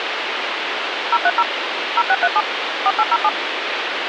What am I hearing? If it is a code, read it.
DTMF, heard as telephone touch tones, dialled by machine, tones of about 50 ms, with phone line noise. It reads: 030 0637 4807